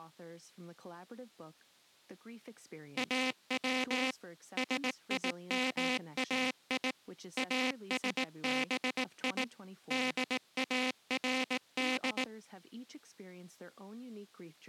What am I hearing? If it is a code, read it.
Morse code (Persian alphabet), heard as a buzzer, machine-sent, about 18 wpm, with speech in English. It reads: او سیمای اسبی دارد